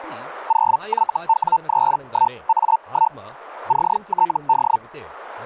Hellschreiber (Feld-Hell, 122.5 baud), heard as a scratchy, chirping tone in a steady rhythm, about 900 Hz, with speech in Telugu. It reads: 0YW31A1 CTD